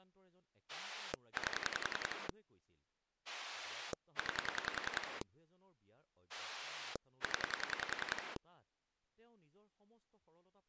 Pulse dialling, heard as a rotary dial, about 10 pulses a second, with speech in Assamese. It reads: 8 9 0